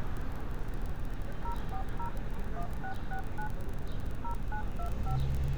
DTMF, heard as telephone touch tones, dialled by machine, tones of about 90 ms, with street noise. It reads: 040 1669 0925